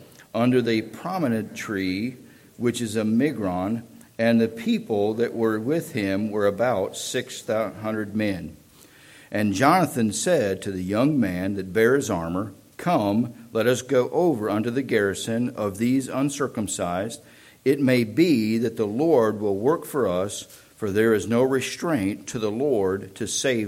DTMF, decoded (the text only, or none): none